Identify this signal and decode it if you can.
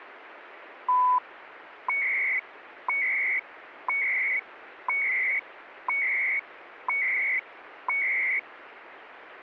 Radio time signal (CHU, Canada), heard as beeps and data bursts, one a second, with radio static.